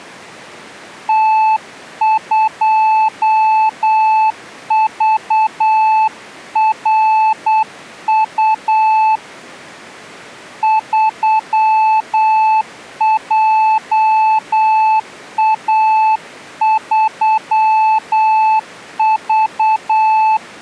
Morse code, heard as a keyed tone, hand-sent with a paddle, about 8 wpm, 870 Hz. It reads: T2VRU 3JA3V